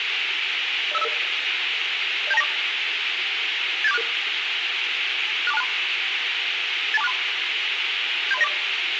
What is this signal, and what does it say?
Five-tone selective call (EIA), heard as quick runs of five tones, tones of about 30 ms, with radio hiss. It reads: 05055 07294 87466 64263 82463 73094